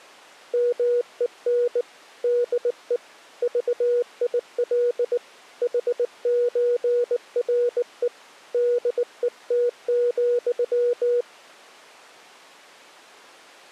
Morse code (with Danish letters), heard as a keyed tone, hand-sent with a bug key, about 19 wpm, 480 Hz. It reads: MEN DE VIL HØRE DET,